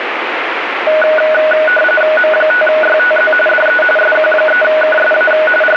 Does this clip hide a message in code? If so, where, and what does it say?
Yes: RTTY (45.45 baud, 850 Hz shift) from 0.9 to 5.8 s, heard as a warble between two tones, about 1050 Hz centre, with radio static. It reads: M5YTZ DE SQ3KSA …